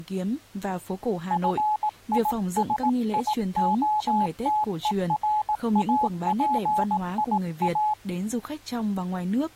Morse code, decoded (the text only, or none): FISIOTERAPIA